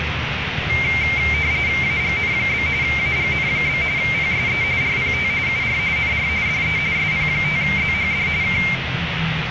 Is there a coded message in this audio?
Yes: RTTY (45.45 baud, 170 Hz shift) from 0.7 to 8.8 s, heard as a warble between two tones, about 2200 Hz centre, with radio static, room echo and the noise of a residential street. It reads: AGN? AGN? PSE RPT UR NR DE SP5ZHD K